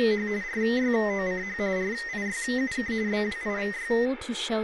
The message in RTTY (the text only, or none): … RYOCH RIYUK BWIVY